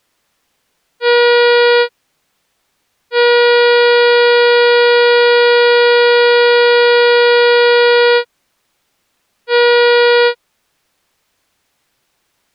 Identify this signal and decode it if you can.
Ship horn signal, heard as a ship's horn, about 480 Hz. 1 short, 1 long, 1 short. At sea: a vessel at anchor warns of its position.